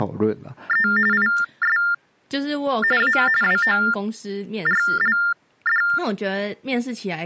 TTY/TDD text telephone tones (45.45 baud Baudot), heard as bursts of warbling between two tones, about 400 Hz shift, 1600 Hz centre, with speech in Chinese. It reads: … IS A WORLD